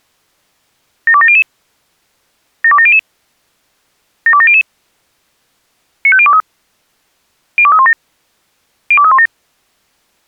Five-tone selective call (ZVEI), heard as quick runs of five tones, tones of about 70 ms. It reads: 72700 72700 72700 95023 02317 02317